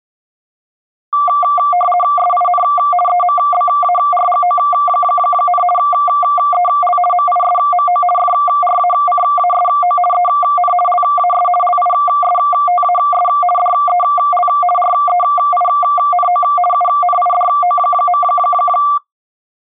RTTY (50 baud, 450 Hz shift), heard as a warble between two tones, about 940 Hz centre. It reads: SIN EMBARGO, EL MISMO FRACASO EN LAS LISTAS DEL REINO UNIDO.